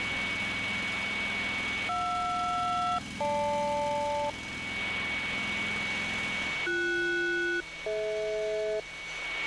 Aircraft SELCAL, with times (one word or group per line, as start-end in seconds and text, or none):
1.9-4.3 JR-GL
6.7-8.8 BS-DH